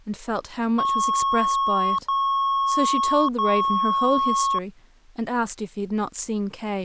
Beep code, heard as beeps, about 1100 Hz, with speech in English. 3 long. In IBM BIOS tables: keyboard card error.